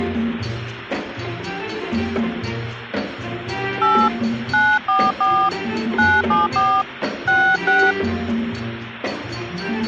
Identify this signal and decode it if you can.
DTMF, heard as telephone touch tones, dialled by hand, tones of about 230 ms. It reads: 8 944 974 66